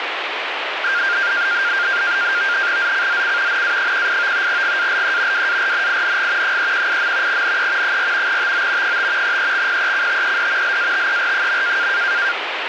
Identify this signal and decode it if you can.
NAVTEX (SITOR-B), 100 baud, 170 Hz shift, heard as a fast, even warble, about 1500 Hz centre, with radio static. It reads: ZCZC NA18 GALE WARNING 318. NE 4 TO 5 EXPECTED LATER.